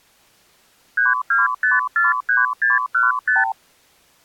Multi-frequency trunk signalling (R2, with the far end's replies), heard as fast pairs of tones, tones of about 160 ms. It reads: 32543615